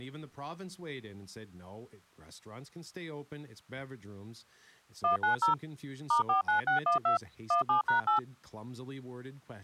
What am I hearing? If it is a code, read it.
DTMF, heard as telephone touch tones, dialled by machine, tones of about 120 ms, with speech in English. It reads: 190 *49612 17#8